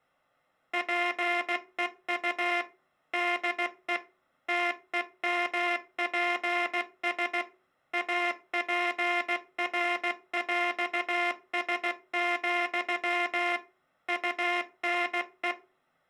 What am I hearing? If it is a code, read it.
Morse code (with French letters), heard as a buzzer, machine-sent, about 16 wpm. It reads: PEU DE TEMPS APRÈS, UNE